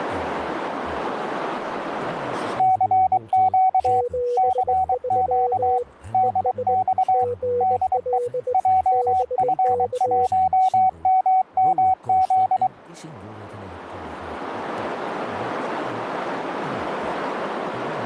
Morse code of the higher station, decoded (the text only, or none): CQ CQ DX DE JF1MMZ